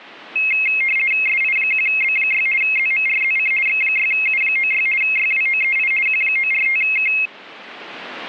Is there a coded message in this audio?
Yes: RTTY (50 baud, 450 Hz shift) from 0.4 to 7.3 s, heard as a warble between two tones, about 2350 Hz centre. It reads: SI1B6 ZMRZC X6U96 YWOEI Q945K